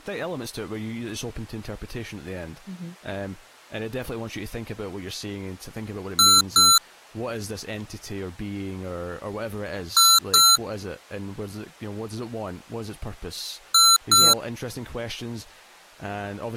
Beep code, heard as beeps from a small speaker, played three times, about 1350 Hz, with speech in English. 2 short. In AMI BIOS tables: memory parity error; in IBM BIOS tables: self-test error shown on screen; in Dell tables: no memory detected.